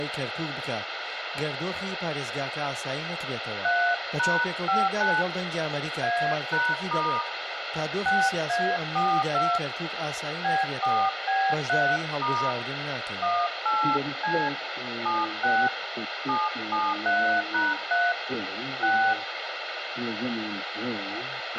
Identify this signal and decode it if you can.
DTMF, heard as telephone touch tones, dialled by hand, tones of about 270 ms, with radio hiss and a squelch burst at the end. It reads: 3#59 A#* 6A42 B4B3* 18C 76 773#3 6